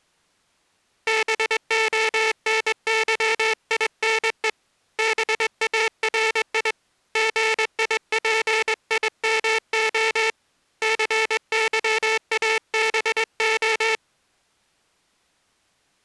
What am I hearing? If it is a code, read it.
Morse code, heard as a buzzer, hand-sent with a straight key, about 22 wpm. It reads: BONYINE BARI GIPIMO CYABO